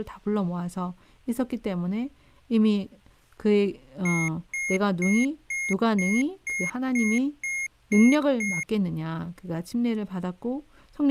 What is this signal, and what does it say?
Beep code, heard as beeps from a small speaker, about 2150 Hz, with speech in Korean. 10 short. In AMI BIOS tables: CMOS shutdown register error.